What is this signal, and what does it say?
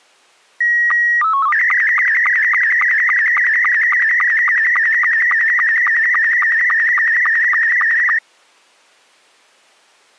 SSTV (slow-scan television), Scottie S2, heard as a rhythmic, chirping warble.